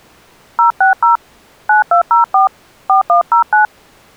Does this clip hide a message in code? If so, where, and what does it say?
Yes: DTMF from 0.6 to 3.7 s, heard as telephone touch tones, dialled by hand, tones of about 130 ms. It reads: 060 9204 4109